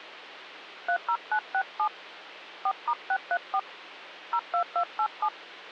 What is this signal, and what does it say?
DTMF, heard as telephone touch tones, dialled by hand, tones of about 80 ms, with phone line noise and hum. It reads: 30967 4*634 02287